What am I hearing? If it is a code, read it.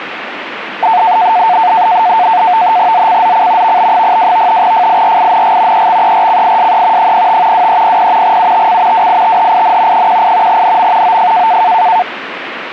NAVTEX (SITOR-B), 100 baud, 170 Hz shift, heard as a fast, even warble, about 810 Hz centre, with radio static. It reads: ZCZC VB02 FIRING EXERCISE 05 2300 UTC WITHIN 18 NM OF